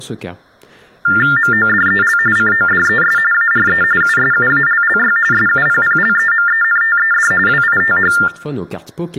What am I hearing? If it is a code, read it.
TTY/TDD text telephone tones (45.45 baud Baudot), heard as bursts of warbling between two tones, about 400 Hz shift, 1600 Hz centre, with speech in French. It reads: MODEL CODES ARE USUALLY SUPPLEMENTED WITH